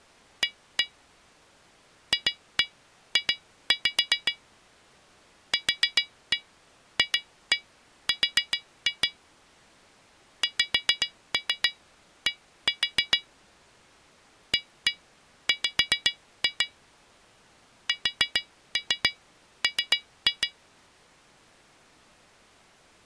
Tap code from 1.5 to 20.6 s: FJ QFR XD AW SM

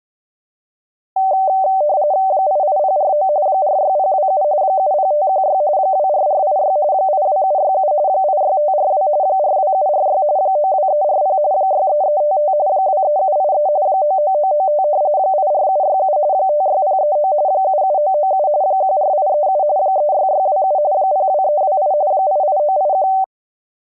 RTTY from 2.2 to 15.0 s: 88049 46027 70516 24486 82767 86542 42746 92340 63355 23783 99995

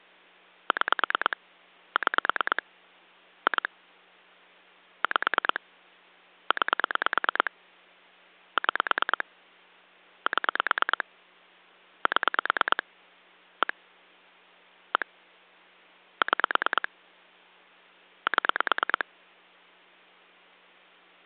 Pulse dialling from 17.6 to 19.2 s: 7

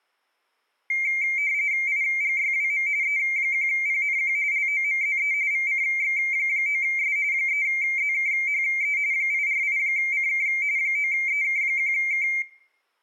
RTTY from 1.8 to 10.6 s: IGYWM E1PNQ LOMZE VCX9S 3ZKHE 848CK

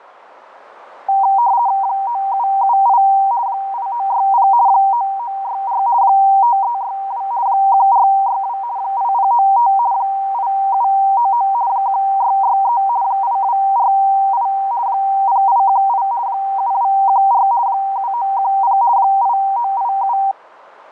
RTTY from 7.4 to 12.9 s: 1462 8095 8799 1663

